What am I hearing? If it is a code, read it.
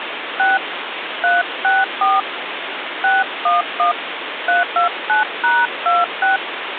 DTMF, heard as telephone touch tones, dialled by hand, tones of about 170 ms, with phone line noise. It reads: 6 364 611 329#26